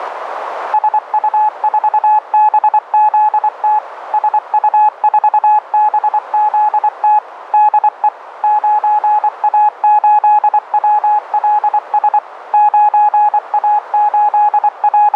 Morse code, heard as a keyed tone, machine-sent, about 24 wpm, 840 Hz, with radio static and a narrow filter. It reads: SU4BZT SU4BZT DE 9A8WLS …